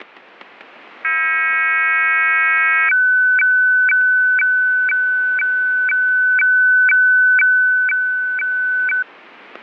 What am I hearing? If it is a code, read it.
Weather fax (radiofax), 120 lines a minute, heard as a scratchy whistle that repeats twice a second, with static crashes.